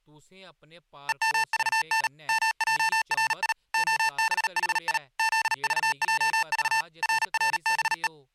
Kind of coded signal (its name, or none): Morse code